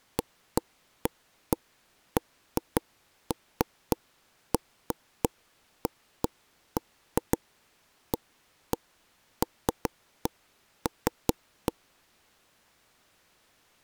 Irregular taps on a table. There is no code.